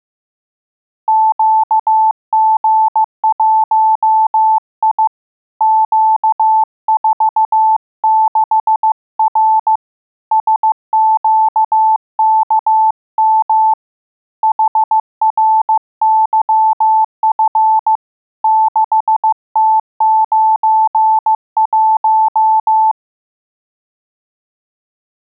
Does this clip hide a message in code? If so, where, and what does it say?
Yes: Morse code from 1.0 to 23.0 s, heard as a keyed tone, hand-sent with a paddle, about 15 wpm, 880 Hz. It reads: QG1I Q46R SQKM HRYF 6T91